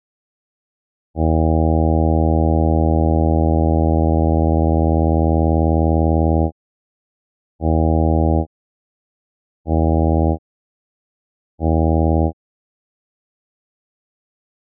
Ship horn signal, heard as a ship's horn, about 80 Hz. 1 long, 3 short. At sea: a vessel under tow in fog.